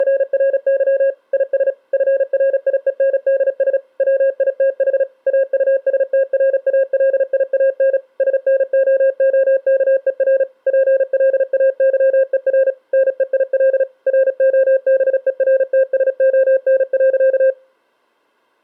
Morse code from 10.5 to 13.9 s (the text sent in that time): PLAYER NEIL